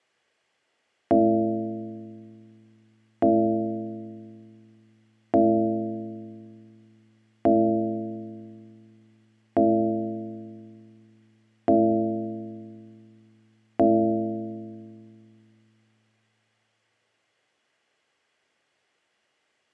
Clock strike, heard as a bell, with room echo. 7. Seven o'clock.